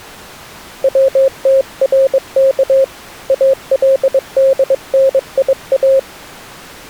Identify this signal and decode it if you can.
Morse code (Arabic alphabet), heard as a keyed tone, hand-sent with a bug key, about 22 wpm, 540 Hz. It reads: وترك الدنيا